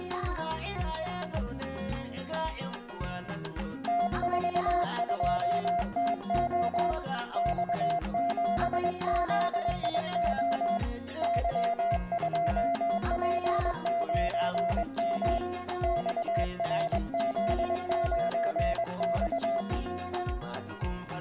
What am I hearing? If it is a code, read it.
Morse code, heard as a keyed tone, hand-sent with a straight key, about 22 wpm, 690 Hz, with room echo. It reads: T42TO X7ZIO Y2P9M XRZ9X